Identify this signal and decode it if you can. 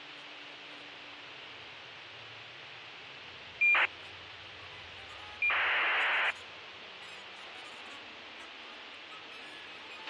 ACARS aircraft data, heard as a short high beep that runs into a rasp, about 2400 baud, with radio hiss and a squelch burst at the end.